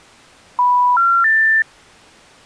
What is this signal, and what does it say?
Telephone call progress tone (North American plan), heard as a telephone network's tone, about 980, 1370, 1800 Hz. Special information tone.